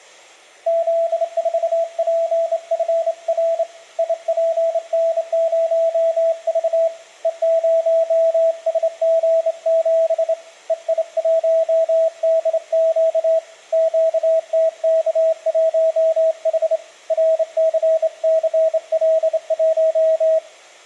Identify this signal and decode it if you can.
Morse code, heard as a keyed tone, hand-sent with a straight key, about 27 wpm, 650 Hz, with room echo. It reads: Z4PFR IPN0V E0SG7 EI1DQ QTK1H RCCL1